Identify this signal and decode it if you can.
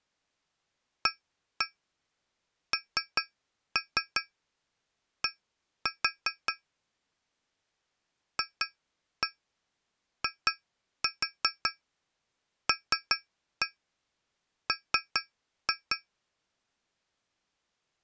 Tap code, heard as taps on glass, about 5 knocks a second. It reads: AND FILM